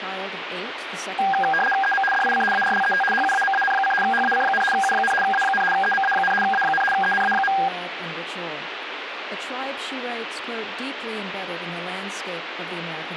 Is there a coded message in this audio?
Yes: RTTY (75 baud, 850 Hz shift) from 1.2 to 7.7 s, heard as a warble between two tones, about 1200 Hz centre, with radio static. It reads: EM DIC ARLET HUAMAN: HAC, U, A, EMA, A, ENA.